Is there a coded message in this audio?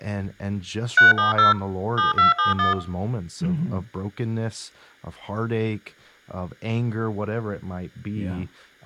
Yes: DTMF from 1.0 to 2.7 s, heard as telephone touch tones, dialled by machine, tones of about 140 ms, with speech in English. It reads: 370 7271